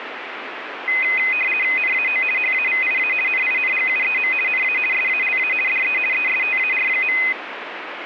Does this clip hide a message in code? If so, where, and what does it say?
Yes: RTTY (50 baud, 450 Hz shift) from 0.9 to 7.3 s, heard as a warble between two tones, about 2250 Hz centre, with radio static. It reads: NAO HAVIA NINGUEM NA SALA DE ESTAR.